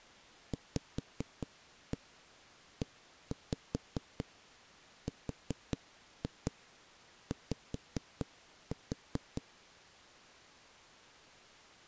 Tap code, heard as knocks on wood, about 4 knocks a second. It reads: VERY